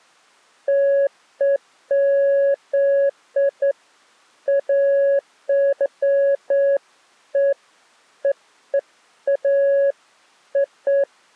Beeps of irregular length. There is no code.